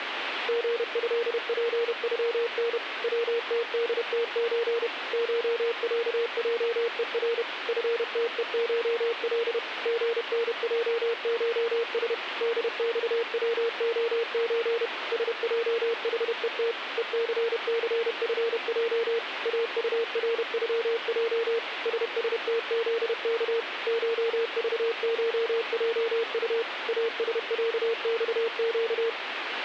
Morse code (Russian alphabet), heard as a keyed tone, machine-sent, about 31 wpm, 460 Hz, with radio static. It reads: ГЭПЮН ВТДТЧ ШЯЙЕР ФТЕШЛ ГНЙШС ДЬВОЧ СЙХЕТ ЕЦЦФЙ АУРЮЙ ССТЗК ШЖШЙУ АСЯЬЩ